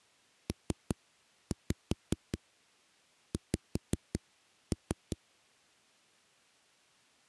Tap code, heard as knocks on a wall, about 5 knocks a second. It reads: PX